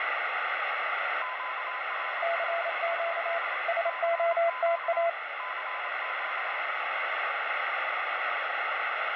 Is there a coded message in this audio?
Yes: Morse code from 1.2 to 6.7 s, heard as two keyed tones, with heavy radio static. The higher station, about 26 wpm, 1020 Hz: QRL? CQ CQ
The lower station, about 28 wpm, 680 Hz: CQ SOTA